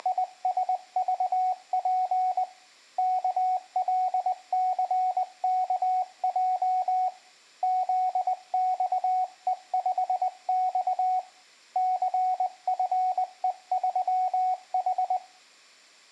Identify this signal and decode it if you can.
Morse code, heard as a keyed tone, hand-sent with a paddle, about 20 wpm, 740 Hz, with room echo. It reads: … KLCKJ ZXE5X CFE3H